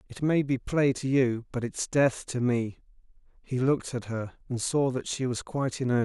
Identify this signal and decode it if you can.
Speech in English. There is no code.